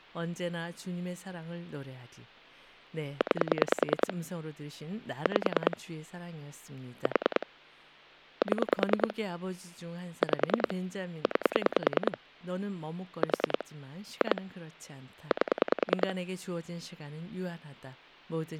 Pulse dialling, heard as clicks on a phone line, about 10 pulses a second, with speech in Korean. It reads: 9 5 4 7 5 9 4 2 8